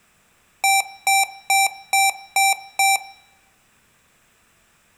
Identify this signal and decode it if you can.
Beep code, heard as beeps from a small speaker, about 780 Hz, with room echo. 6 short. In AMI BIOS tables: keyboard controller gate A20 failure; in Dell tables: video card failure.